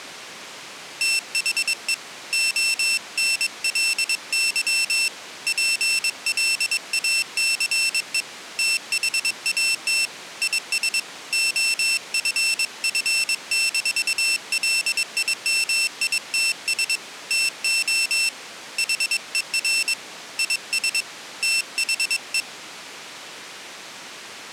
Morse code, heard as a high beeper, hand-sent with a paddle, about 22 wpm, 2700 Hz. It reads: THE ONLY PLACE THAT IS OFF-LIMITS TO HER IS THE